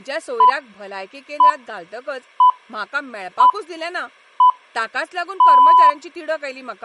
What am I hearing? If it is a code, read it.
Radio time signal (six pips, as the Greenwich Time Signal), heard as pips, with speech in Goan Konkani.